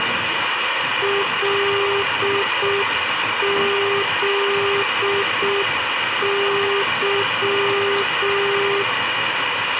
Morse code, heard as a keyed tone, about 6 wpm, 400 Hz, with radio hiss, a squelch burst at the end, room echo and the noise of a restroom. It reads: LZY